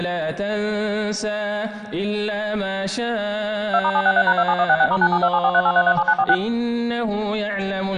DTMF, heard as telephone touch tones, dialled by machine, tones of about 60 ms. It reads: 2*763#27166*9727438337946